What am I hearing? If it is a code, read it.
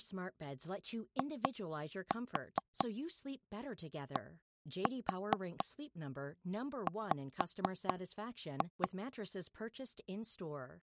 Tap code, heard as taps on a table, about 4 knocks a second, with speech in English. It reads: IDW